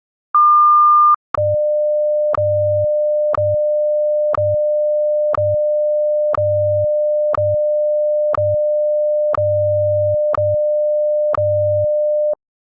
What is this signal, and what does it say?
Radio time signal (WWVH, Hawaii), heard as ticks, one a second.